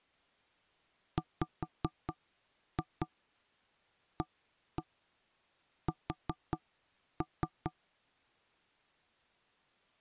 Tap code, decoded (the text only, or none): WAS